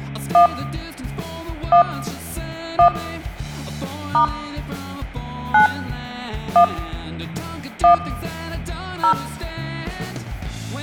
DTMF, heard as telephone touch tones, dialled by hand, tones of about 100 ms, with hum and room echo. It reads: 1 1 1 * 9 1 1 0